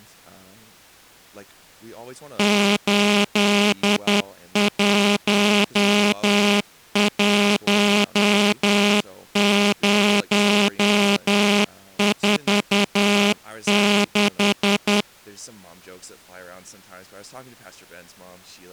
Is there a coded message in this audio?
Yes: Morse code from 2.3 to 15.1 s, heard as a buzzer, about 10 wpm, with speech in English. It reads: 811046